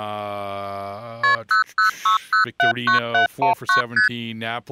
Multi-frequency trunk signalling (R1, as on North American trunks), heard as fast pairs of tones, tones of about 120 ms, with speech in English. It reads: KP 006079719 ST